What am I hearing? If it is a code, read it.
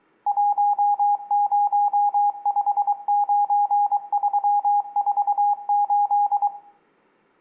Morse code, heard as a keyed tone, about 23 wpm, 820 Hz, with room echo. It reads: 1059348